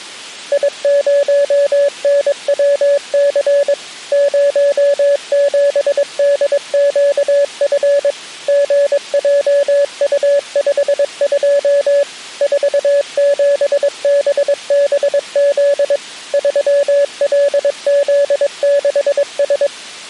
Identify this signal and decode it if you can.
Morse code, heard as a keyed tone, machine-sent, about 22 wpm, 570 Hz. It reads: I0NWC 07DQF GJU52 47BBZ 3LZ6S